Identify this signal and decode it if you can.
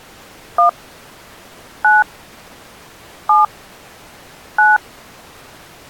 DTMF, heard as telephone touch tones, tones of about 160 ms. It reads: 1 9 7 9